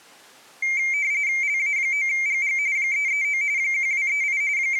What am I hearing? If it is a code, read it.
RTTY (45.45 baud, 170 Hz shift), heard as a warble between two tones, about 2200 Hz centre. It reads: LA9GG 339 1238 …